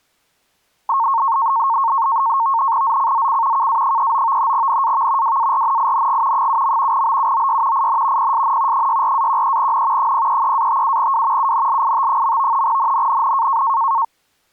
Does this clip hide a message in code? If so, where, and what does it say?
Yes: NAVTEX (SITOR-B), 100 baud, 170 Hz shift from 0.9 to 14.0 s, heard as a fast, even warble, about 1000 Hz centre. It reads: ZCZC KA39 NAV WARNING 7. BUOY IN PSN 64-13N 033-57W UNLIT. NNNN